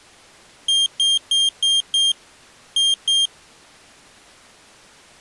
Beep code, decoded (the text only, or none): 5-2